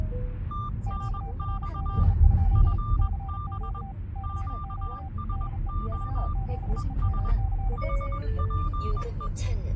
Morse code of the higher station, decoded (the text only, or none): TNX FB QSO ES HPE